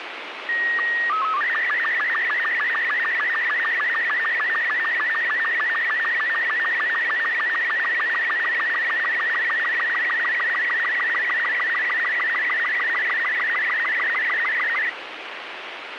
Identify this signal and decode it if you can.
SSTV (slow-scan television), Robot 36, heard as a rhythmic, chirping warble, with radio hiss.